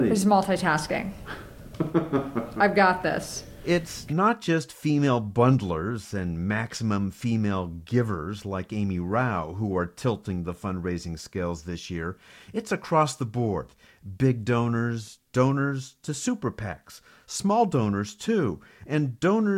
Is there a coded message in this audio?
No, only speech in English.